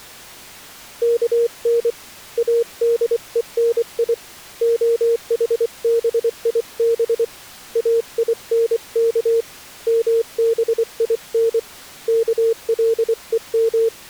Morse code (Hebrew alphabet), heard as a keyed tone, hand-sent with a paddle, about 24 wpm, 460 Hz. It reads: כן אדוני החביב אינך מבין כלום